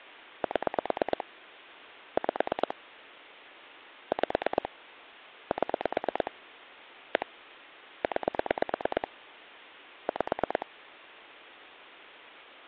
Pulse dialling, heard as clicks on a phone line, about 9 pulses a second, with phone line noise. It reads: 7 5 5 7 1 9 5